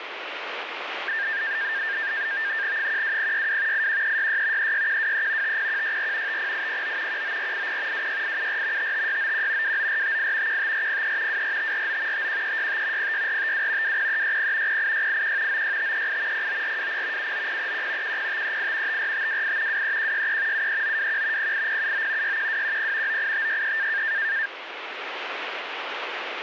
NAVTEX (SITOR-B), 100 baud, 170 Hz shift, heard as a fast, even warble, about 1700 Hz centre, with radio static. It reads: 12062 81366 36123 50164 50809 19480 26874 55691 29458 15403 24549 51365 06452 20360 08681 96538 09420 79031 10538 54528 23163 73921 08079 61210 98563